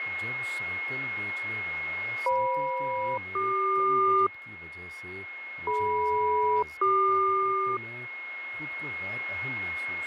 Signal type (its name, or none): aircraft SELCAL